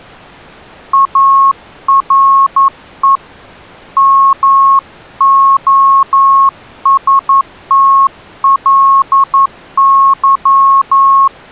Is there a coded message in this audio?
Yes: Morse code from 0.9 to 11.3 s, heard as a keyed tone, hand-sent with a paddle, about 11 wpm, 1090 Hz. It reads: ARE MOSTLY